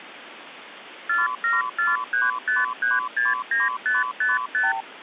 Multi-frequency trunk signalling (R2, with the far end's replies), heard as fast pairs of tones, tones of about 170 ms, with phone line noise. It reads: 47435369555